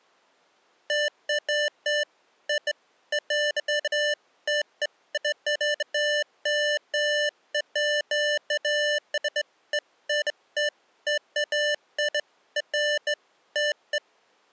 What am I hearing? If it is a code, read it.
Beeps of irregular length. There is no code.